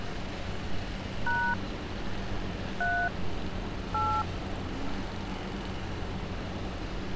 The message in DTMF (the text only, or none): # 3 8